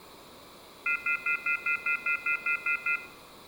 Telephone call progress tone (North American plan), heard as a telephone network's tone, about 1400, 2050, 2450, 2600 Hz, 0.1 s on and 0.1 s off, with room echo. Off-hook warning tone.